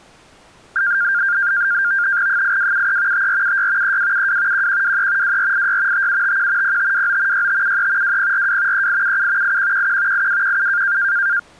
NAVTEX (SITOR-B), 100 baud, 170 Hz shift, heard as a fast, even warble, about 1500 Hz centre. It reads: 8273 5476 3272 1123 2486 5751 0529 6573 2042 3877 8111 8217